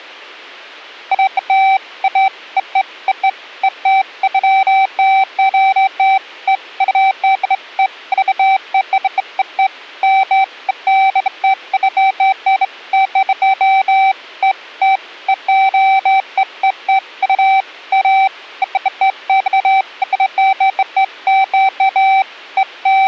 Beeps of irregular length. There is no code.